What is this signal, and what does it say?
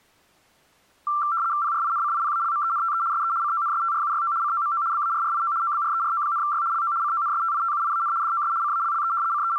RTTY (75 baud, 170 Hz shift), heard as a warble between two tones, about 1260 Hz centre. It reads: PRINCIPALMENTE SE CONSTRUYO COMO BARRIO OBRERO,Y LO CONSTITUIAN DOS CALLE …